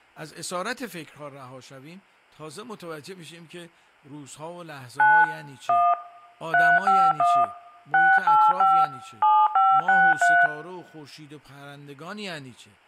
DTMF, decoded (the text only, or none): 9 1 351 685 7563